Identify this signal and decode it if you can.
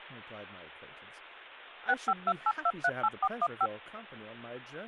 DTMF, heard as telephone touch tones, dialled by machine, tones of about 50 ms, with speech in English. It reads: 6528238415